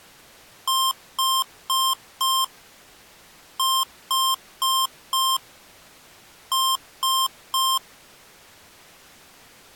Beep code, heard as beeps from a small speaker, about 1060 Hz. 4-4-3. In Phoenix BIOS tables: maths coprocessor failure.